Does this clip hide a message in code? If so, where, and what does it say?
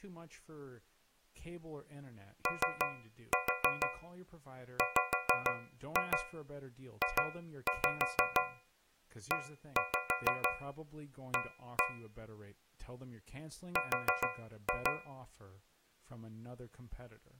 Yes: tap code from 2.5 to 15.3 s, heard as taps on a metal pipe, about 6 knocks a second, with speech in English. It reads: OWJEA R